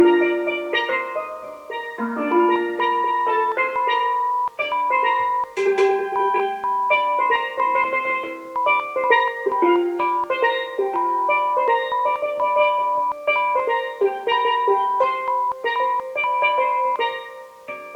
Morse code, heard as a keyed tone, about 5 wpm, 990 Hz. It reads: JRHCX